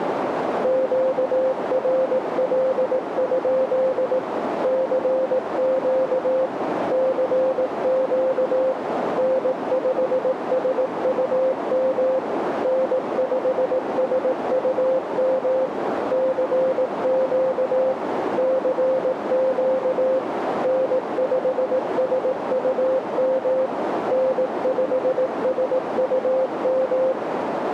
Morse code, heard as a keyed tone, machine-sent, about 18 wpm, 520 Hz, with radio static and a narrow filter. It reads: QRL? CQ CQ N5SUM N5SUM CQ CQ N5SUM N5SUM